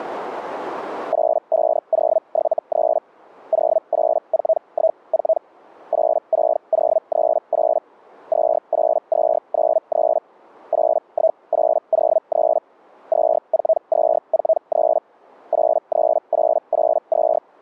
Hellschreiber (Feld-Hell, 122.5 baud), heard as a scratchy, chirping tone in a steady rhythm, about 640 Hz. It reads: 85073 08414 86038 28293 81803 24243 83882